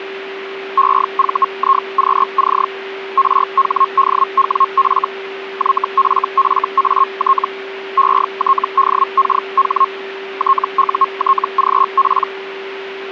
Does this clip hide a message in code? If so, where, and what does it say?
Yes: Hellschreiber (Feld-Hell, 122.5 baud) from 0.8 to 12.3 s, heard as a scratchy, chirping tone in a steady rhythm, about 1080 Hz, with a steady whistle near 390 Hz. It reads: EVIQC RHDWF YFFAT ETDKH TUTGP